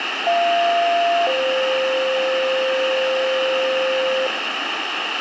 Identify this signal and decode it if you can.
Two-tone page, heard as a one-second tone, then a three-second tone, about 690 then 520 Hz, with radio hiss and room echo.